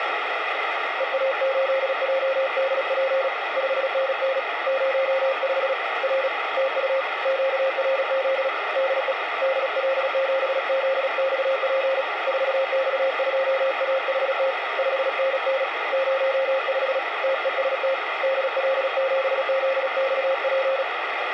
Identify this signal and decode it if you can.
Morse code, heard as a keyed tone, hand-sent with a paddle, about 36 wpm, 540 Hz, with radio static. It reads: EA8JDP 5NN 05 R TU QRZ DE DL7ZXP 4X2AHT 5NN 05 TEST DL7ZXP